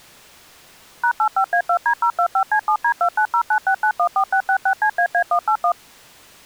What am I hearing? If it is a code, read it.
DTMF, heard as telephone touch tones, dialled by machine, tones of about 80 ms. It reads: #85A2D025C7D29096914666CAA181